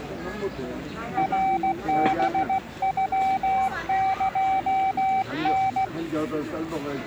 Morse code (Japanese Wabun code), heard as a keyed tone, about 16 wpm, 770 Hz, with the noise of a park. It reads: ナハノエタ